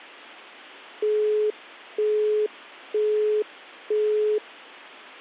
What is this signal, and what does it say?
Telephone call progress tone (single-tone plan, as in Europe, Japan and elsewhere), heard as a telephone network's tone, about 420 Hz, 0.48 s on and 0.48 s off. Busy tone.